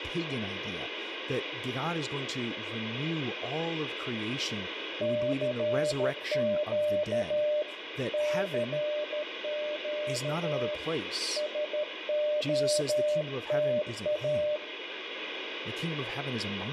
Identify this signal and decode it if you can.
Morse code, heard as a keyed tone, hand-sent with a paddle, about 13 wpm, 600 Hz, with radio static, room echo and speech in English. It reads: CQ CQ SOTA